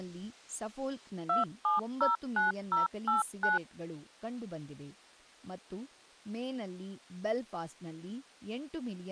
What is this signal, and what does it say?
DTMF, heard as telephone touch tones, dialled by machine, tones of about 150 ms, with speech in Kannada. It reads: 2709089